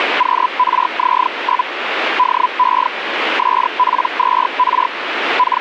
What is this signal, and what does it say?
Hellschreiber (Feld-Hell, 122.5 baud), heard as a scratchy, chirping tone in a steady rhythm, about 1000 Hz, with radio static. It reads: QRZ? DE SP2R …